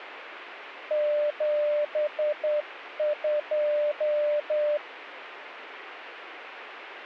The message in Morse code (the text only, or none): 72